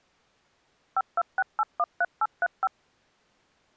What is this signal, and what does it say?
DTMF, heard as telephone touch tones, dialled by machine, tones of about 40 ms. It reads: 526813835